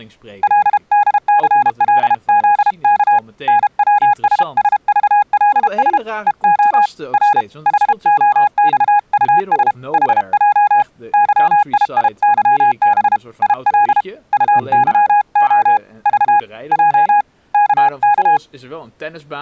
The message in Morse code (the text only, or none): LDCLZK NWSSVLS EO R HOXUS HJ YIIYB IL UYO V J KK